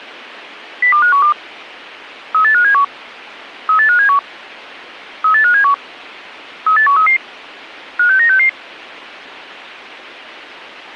Five-tone selective call (CCIR), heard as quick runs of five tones, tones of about 100 ms. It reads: 02512 38571 38571 38571 38133 56966